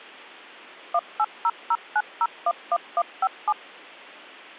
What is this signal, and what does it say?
DTMF, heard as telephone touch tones, dialled by machine, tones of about 50 ms. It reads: 18009011157